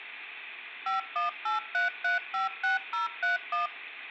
DTMF, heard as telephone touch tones, dialled by machine, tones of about 140 ms. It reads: 5183356031